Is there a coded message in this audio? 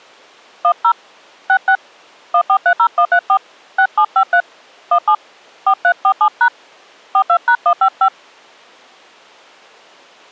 Yes: DTMF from 0.6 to 8.1 s, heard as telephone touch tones, dialled by hand, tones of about 80 ms. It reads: 10 66 1430134 6753 17 4347# 42#155